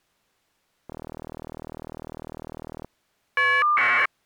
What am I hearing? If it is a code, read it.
Caller ID data burst, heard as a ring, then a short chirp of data, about 1200 baud.